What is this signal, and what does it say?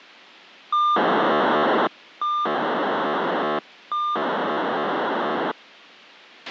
POCSAG pager data (2400 baud), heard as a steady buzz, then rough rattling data, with a squelch burst at the end.